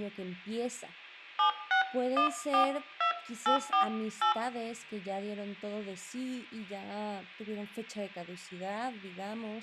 DTMF, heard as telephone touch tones, dialled by hand, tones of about 110 ms, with room echo and speech in Spanish. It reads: 76142848